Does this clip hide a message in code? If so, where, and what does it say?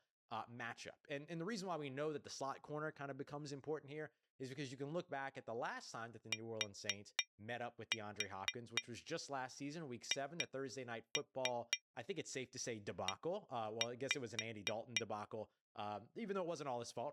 Yes: tap code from 6.3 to 15.1 s, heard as taps on glass, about 4 knocks a second, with speech in English. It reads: THE